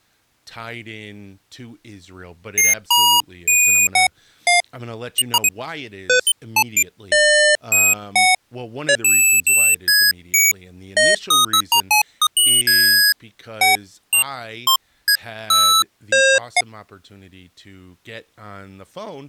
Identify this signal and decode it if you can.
Electronic bleeps of random pitch and length, with speech in English. There is no code.